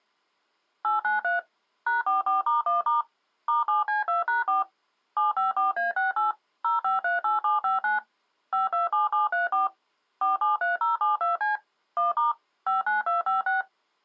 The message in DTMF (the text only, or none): 893 #44*1* *7C2#4 754A68 0538759 527734 473072C 1* 59256